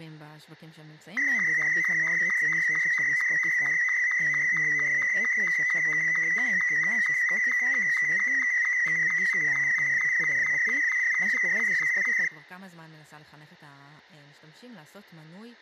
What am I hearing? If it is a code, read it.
SSTV (slow-scan television), Martin M2, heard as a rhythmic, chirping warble, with speech in Hebrew.